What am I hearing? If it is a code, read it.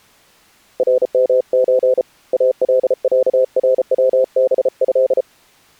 Morse code (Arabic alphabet), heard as a keyed tone, hand-sent with a paddle, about 34 wpm, 520 Hz. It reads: رمز العروبه